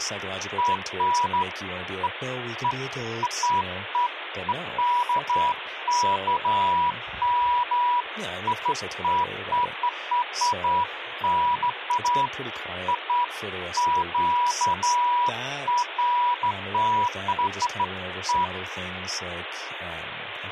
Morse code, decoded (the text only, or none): none